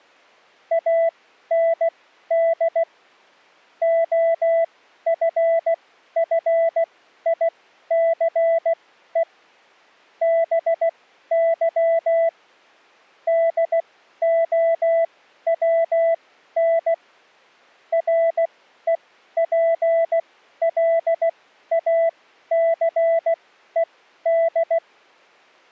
Morse code, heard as a keyed tone, machine-sent, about 16 wpm, spaced as for 12 wpm, 660 Hz. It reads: AND OFFICE BY DOWN REPLACED